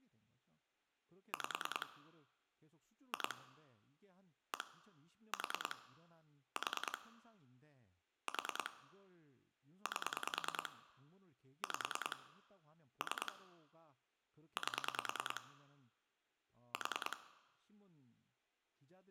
Pulse dialling, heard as clicks on a phone line, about 10 pulses a second, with room echo and speech in Korean. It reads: 5 2 1 4 4 4 8 5 3 8 4